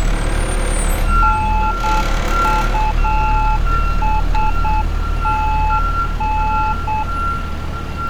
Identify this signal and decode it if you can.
Morse code, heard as a keyed tone, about 8 wpm, 860 Hz, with street noise. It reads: NUSTN